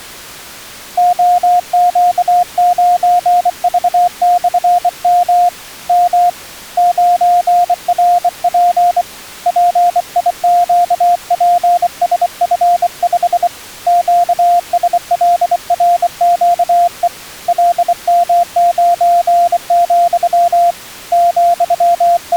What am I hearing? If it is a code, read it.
Morse code, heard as a keyed tone, hand-sent with a bug key, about 24 wpm, 700 Hz. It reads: OQ9V/M M 9RP PIQPSF5 QSLRQE LM9, …